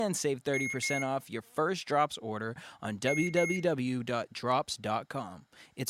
Beep code, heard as beeps from a small speaker, played twice, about 2150 Hz, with speech in English. 2 short. In AMI BIOS tables: memory parity error; in IBM BIOS tables: self-test error shown on screen; in Dell tables: no memory detected.